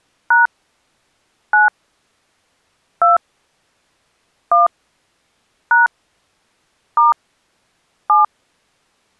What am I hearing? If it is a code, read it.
DTMF, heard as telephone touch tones, dialled by hand, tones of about 150 ms. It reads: # 9 2 1 # * 7